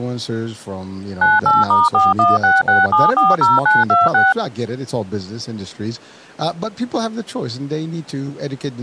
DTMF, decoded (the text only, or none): 98*4166740926